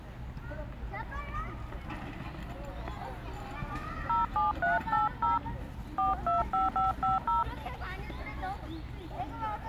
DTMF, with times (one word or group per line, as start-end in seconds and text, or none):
4.1-5.4 07380
6.0-7.4 425550